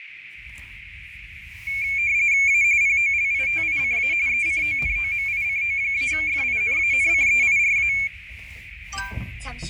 RTTY (45.45 baud, 170 Hz shift), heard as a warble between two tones, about 2300 Hz centre, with radio static, fading, a narrow filter and the noise inside a car. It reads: A POLITICA ECONOMICO-FINANCEIRA